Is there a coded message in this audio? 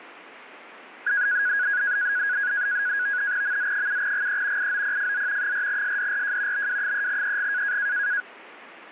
Yes: NAVTEX (SITOR-B), 100 baud, 170 Hz shift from 1.1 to 8.2 s, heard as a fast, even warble, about 1550 Hz centre, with radio static. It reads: MZ7GE IOPFZ 4SDRJ BW3EG